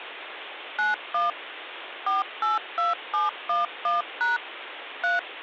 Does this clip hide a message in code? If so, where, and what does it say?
Yes: DTMF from 0.8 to 5.2 s, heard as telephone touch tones, dialled by machine, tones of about 160 ms, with phone line noise. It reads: 91 482711# 3